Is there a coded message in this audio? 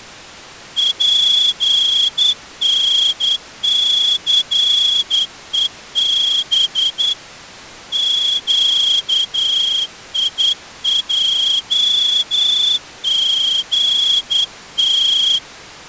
Yes: Morse code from 0.7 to 15.4 s, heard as a whistle, hand-sent with a straight key, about 10 wpm. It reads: PNCEB QIJGT